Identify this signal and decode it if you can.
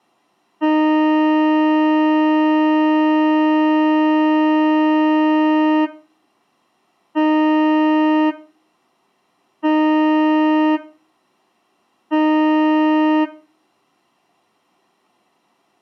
Ship horn signal, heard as a ship's horn, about 310 Hz, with room echo. 1 long, 3 short. At sea: a vessel under tow in fog.